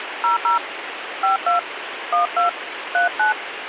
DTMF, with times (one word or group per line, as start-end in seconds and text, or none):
0.2-0.6 00
1.2-1.6 52
2.1-2.5 12
2.9-3.3 39